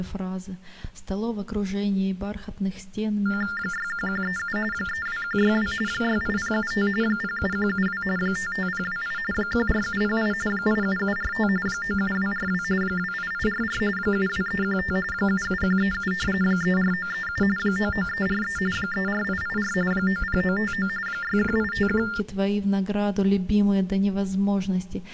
TTY/TDD text telephone tones (45.45 baud Baudot), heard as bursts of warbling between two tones, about 400 Hz shift, 1600 Hz centre. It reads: 61137 32162 68075 07172 55028 14708 87745 97242 28844 72315 77137 34937 99343 34884 90959 61851